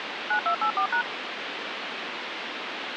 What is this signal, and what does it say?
DTMF, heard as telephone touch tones, dialled by machine, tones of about 90 ms, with phone line noise. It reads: 9284#